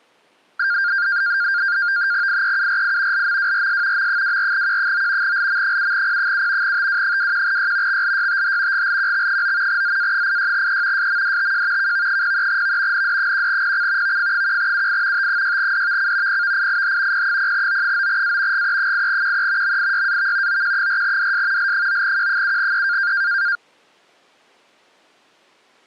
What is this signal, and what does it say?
NAVTEX (SITOR-B), 100 baud, 170 Hz shift, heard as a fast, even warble, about 1500 Hz centre. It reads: IEURI LMWRS M24Q9 LM7P7 TW21Y XLYTH GLQX9 ZA86E SMDTJ KV03V ND1PC VF1UI T6DVC PVIIH P0O9A GE8QE MIYAV OQ4DS L9Q7E